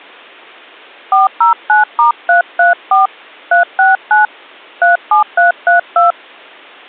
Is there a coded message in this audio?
Yes: DTMF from 1.1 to 6.1 s, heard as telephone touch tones, dialled by hand, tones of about 140 ms. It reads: 409*334 369 37332